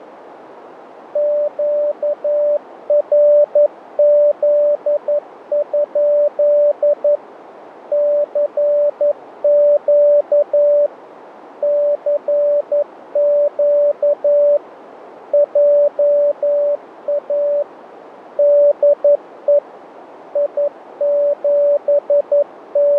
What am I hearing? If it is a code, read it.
Morse code, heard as a keyed tone, machine-sent, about 11 wpm, 580 Hz, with radio static. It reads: QRZ? CQ CQ JA DE …